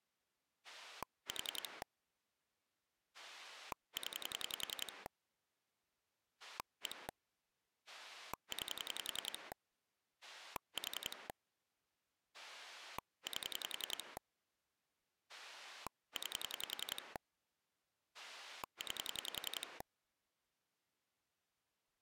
Pulse dialling, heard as a rotary dial, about 10 pulses a second. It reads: 4 0 1 9 4 8 9 9